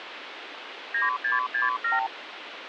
Multi-frequency trunk signalling (R2, with the far end's replies), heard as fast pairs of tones, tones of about 150 ms, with phone line noise. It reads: 9667